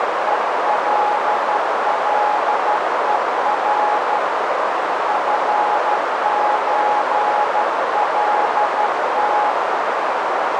Morse code (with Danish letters), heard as a keyed tone, hand-sent with a straight key, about 12 wpm, 840 Hz, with heavy radio static and a narrow filter. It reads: ELLER FØLT